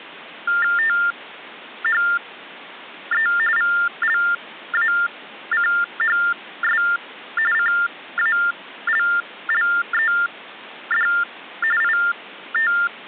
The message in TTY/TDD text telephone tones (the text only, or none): THE VLACHS CALLED IT